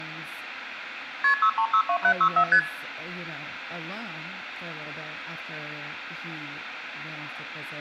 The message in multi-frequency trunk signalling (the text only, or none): KP 6362764 ST